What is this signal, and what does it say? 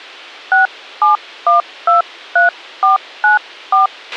DTMF, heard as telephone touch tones, dialled by hand, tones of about 140 ms, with a squelch burst at the end. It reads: 67123494